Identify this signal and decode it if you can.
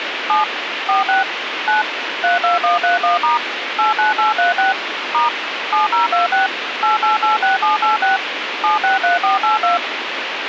DTMF, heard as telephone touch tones, dialled by machine, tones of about 140 ms, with radio hiss. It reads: 7 46 9 32131* 89836 * 7026 8886786 763482